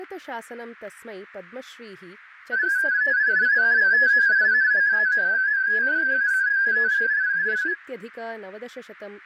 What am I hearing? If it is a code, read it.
Multi-tone FSK (Olivia or MFSK type), about 250 Hz wide, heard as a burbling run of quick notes, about 31.25 baud, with radio static, fading and speech in Sanskrit.